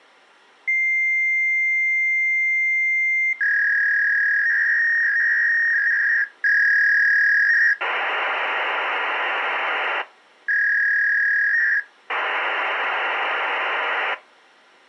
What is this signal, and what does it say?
Fax machine handshake, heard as a long tone, a warble and hiss.